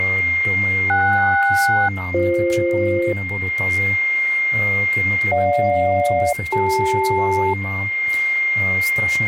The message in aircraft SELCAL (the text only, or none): KS-BF GJ-CL